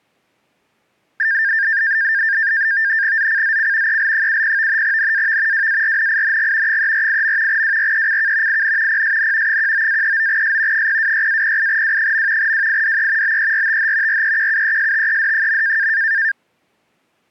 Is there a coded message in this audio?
Yes: NAVTEX (SITOR-B), 100 baud, 170 Hz shift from 1.2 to 16.3 s, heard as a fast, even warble, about 1700 Hz centre. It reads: ZCZC EL70 NAV WARNING 348. WRECK IN PSN 19-39S 026-08W. WIDE BERTH REQUESTED.